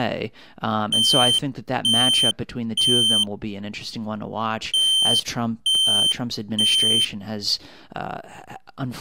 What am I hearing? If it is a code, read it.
Alarm pattern, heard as an alarm's beeps, played twice, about 3100 Hz, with speech in English. Temporal three. Smoke or fire, evacuate.